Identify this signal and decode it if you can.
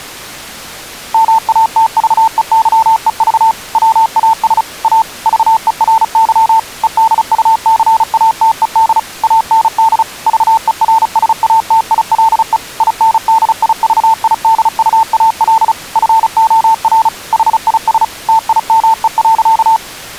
Morse code, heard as a keyed tone, machine-sent, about 35 wpm, 890 Hz. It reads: MATVEYEV WAS A VERY EDUCATED AND VERSATILE INDIVIDUAL FOR HIS TIME.